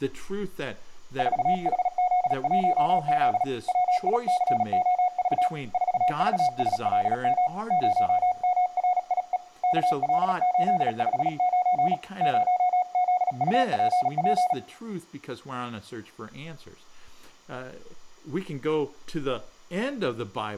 Morse code, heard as a keyed tone, hand-sent with a paddle, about 37 wpm, 730 Hz, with room echo and speech in English. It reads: 4HZ1Z WICOV 4VSLM 0MRIE KL859 0ZUPP